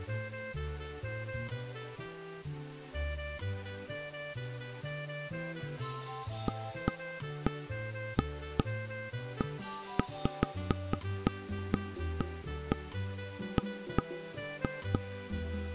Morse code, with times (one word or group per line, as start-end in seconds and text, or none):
none